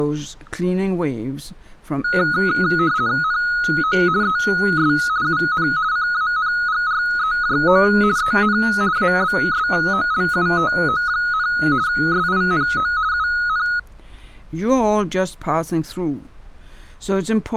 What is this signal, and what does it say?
RTTY (50 baud, 170 Hz shift), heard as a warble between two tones, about 1360 Hz centre. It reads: NO ES UN CANGREJO EN ABSOLUTO, SINO UN